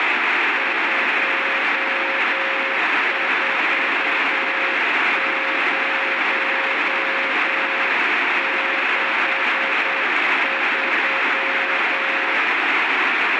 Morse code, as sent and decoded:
..--- ....- ----- -.... ...--
24063

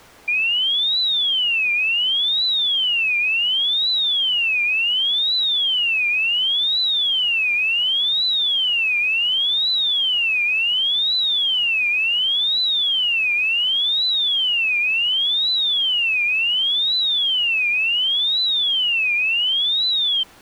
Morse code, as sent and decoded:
none

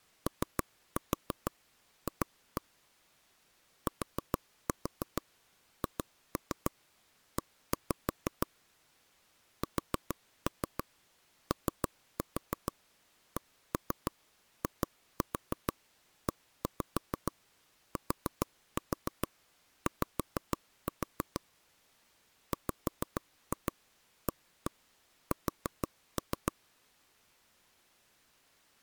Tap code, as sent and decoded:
3-4 2-1 / 4-4 2-3 1-5 / 4-3 3-4 1-3 2-4 1-5 4-4 5-4 / 5-2 1-1 4-3
OF THE SOCIETY WAS

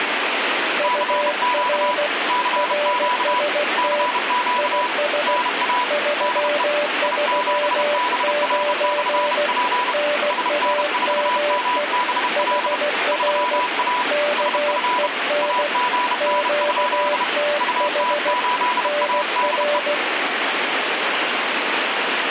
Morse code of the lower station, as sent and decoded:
..- .-. / .-. ... - / .. ... / ...-- ...-- ----. / -. .- -- . / .... .-. / -.- . -. / --.- - .... / -. .-.
UR RST IS 339 NAME HR KEN QTH NR

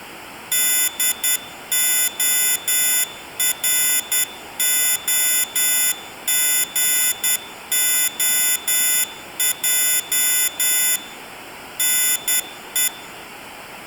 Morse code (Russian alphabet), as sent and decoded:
-.. --- .-. --- --. --- .--- / -. .
ДОРОГОЙ НЕ

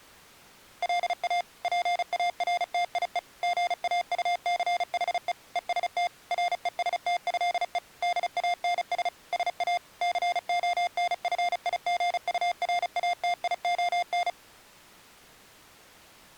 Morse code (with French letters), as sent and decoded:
.-.. .- / .--. .- .-. - .. . / --. .- ..- -.-. .... . / . ... - / .-. . ... - ..-.. . / -.. .- -. ... / ... .- / -.-. --- -. ..-. .. --. ..- .-. .- - .. --- -.
LA PARTIE GAUCHE EST RESTÉE DANS SA CONFIGURATION

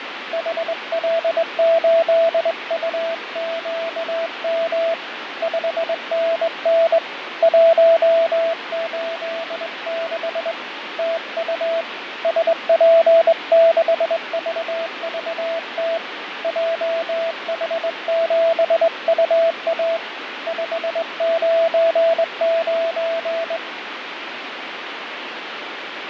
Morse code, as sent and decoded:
.... .-.. ---.. ..- --.- -- / ..... -. -. / .---- ---.. -.... / - ..- / ... .--. -.... ...- ...- - / .--- .... --... ..- .- / ..... ----. ----.
HL8UQM 5NN 186 TU SP6VVT JH7UA 599

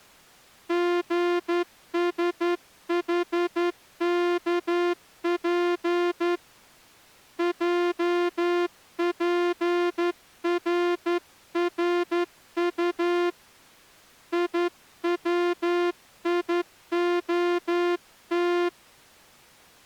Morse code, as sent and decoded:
--. ... .... -.- .--. / .--- .--. .-. .-. ..- / .. .-- .. --- -
GSHKP JPRRU IWIOT

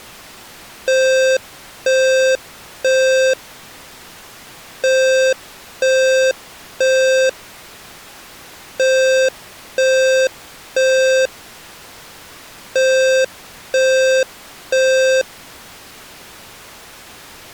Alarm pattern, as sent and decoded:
3 beeps and a pause
temporal three

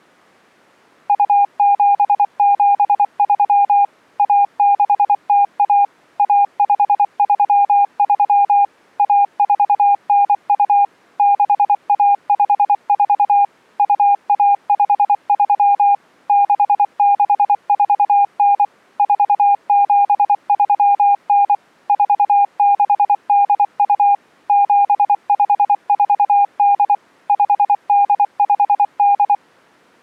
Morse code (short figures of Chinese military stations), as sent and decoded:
..- --... --... ...-- / .- -.... - .- / .- ..... ...-- ...-- / .- ....- -. ..- / -.... .- ..... ....- / ..- .- ..... ...-- / -.... -.... ....- -. / ....- --... ...-- -. / ....- -.... -.. ..- / --... ..... ....- -.. / ..... -.. ..... -..
2773 1601 1533 1492 6154 2153 6649 4739 4682 7548 5858

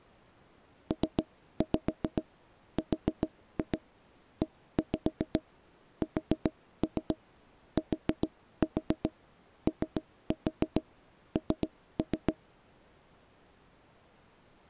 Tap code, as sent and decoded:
3-5 4-2 1-5 4-3 4-4 3-4 3-3
PRESTON

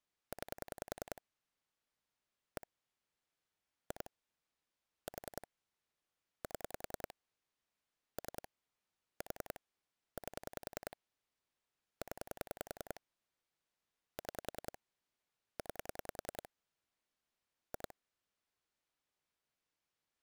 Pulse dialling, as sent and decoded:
9 / 1 / 2 / 4 / 7 / 3 / 4 / 8 / 10 / 6 / 9 / 2
9 1 2 4 7 3 4 8 0 6 9 2

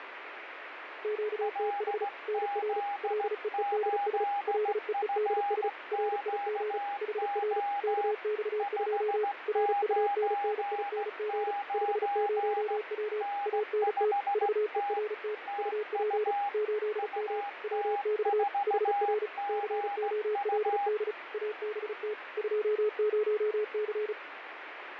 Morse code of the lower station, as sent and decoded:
--.- - .... / -. .-. / .-.. . . -.. ... / .-.. . . -.. ... / .-. .. --. / .... .-. / -.- -..- ..--- / .-. ..- -. -. .. -. --. / ..... ----- .-- / .- -. - / ...- . .-. - / ..- .--. / ---.. -- / .-- -..- / .... .-. / -.-. --- .-.. -.. / .- -... - / ..--- ----- -.-.
QTH NR LEEDS LEEDS RIG HR KX2 RUNNING 50W ANT VERT UP 8M WX HR COLD ABT 20C

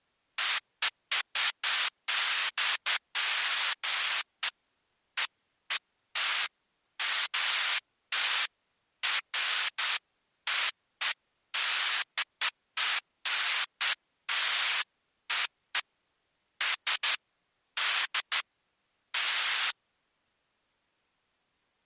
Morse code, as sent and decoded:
none

